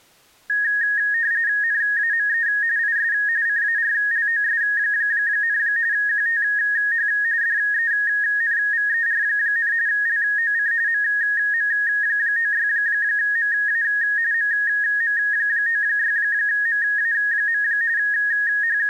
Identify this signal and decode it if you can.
RTTY (45.45 baud, 170 Hz shift), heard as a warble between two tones, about 1750 Hz centre. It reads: NAME IS CARLOS, QTH DENVER, LOC MM96MA MM96MA. …